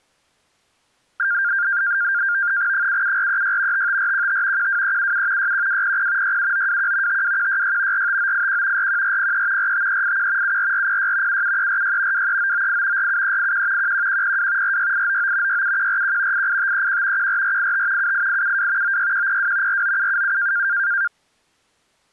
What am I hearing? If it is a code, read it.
NAVTEX (SITOR-B), 100 baud, 170 Hz shift, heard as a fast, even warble, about 1500 Hz centre. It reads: 77436 55415 12377 61200 67921 52166 45981 41403 45381 74406 77346 23998 47381 11102 46899 67141 88531 14485 78872 96102 49777